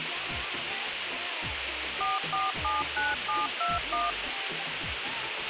DTMF, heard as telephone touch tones, dialled by machine, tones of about 180 ms, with radio hiss and a squelch burst at the end. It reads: 4479721